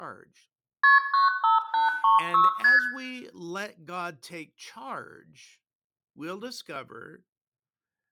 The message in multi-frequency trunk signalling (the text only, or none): KP 95836 ST